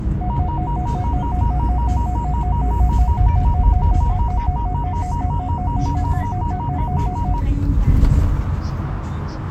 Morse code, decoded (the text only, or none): none